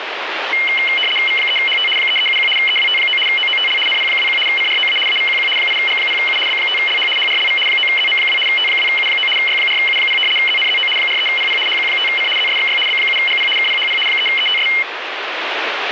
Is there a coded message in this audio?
Yes: RTTY (75 baud, 850 Hz shift) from 0.5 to 14.8 s, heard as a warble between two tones, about 2550 Hz centre, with radio static. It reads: V3HT 3371 EWT9 OOTL NP21 CROA AVQQ 8G0U B5LH HRLV 9ZM2 T2U9 Y4U0 ZNZO 43PP HQ5C ZSXY B7GP KPHP 3ETS